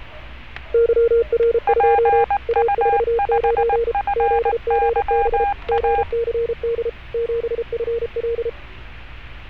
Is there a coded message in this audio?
Yes: Morse code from 0.7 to 8.6 s, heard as two keyed tones, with fading, static crashes and street noise. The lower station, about 33 wpm, 460 Hz: YR2 A49 ZGB GCD 7FL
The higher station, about 19 wpm, 810 Hz: PU5FYA